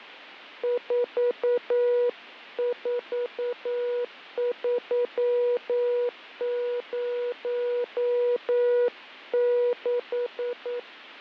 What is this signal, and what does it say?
Morse code, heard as a keyed tone, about 9 wpm, 490 Hz, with fading. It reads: 44306